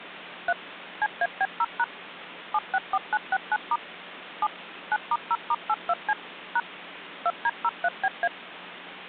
DTMF, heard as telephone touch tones, dialled by machine, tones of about 50 ms, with phone line noise. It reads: 3 CAB0# 764969* 7 9*0*82C # 2D03BA